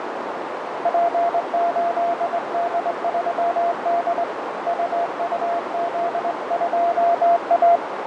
Morse code, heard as a keyed tone, hand-sent with a straight key, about 21 wpm, 690 Hz, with heavy radio static, fading and a narrow filter. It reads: P8D3D UUZ2A